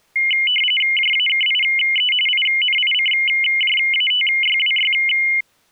RTTY (45.45 baud, 850 Hz shift), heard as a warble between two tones, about 2550 Hz centre. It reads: JAKIE INICJATYWY